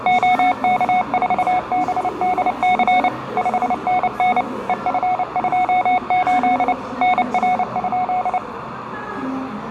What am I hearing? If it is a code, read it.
Morse code, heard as a keyed tone, machine-sent, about 29 wpm, 730 Hz, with radio static and the noise of a crowd indoors. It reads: OK4BDC 5NN EF28 NR?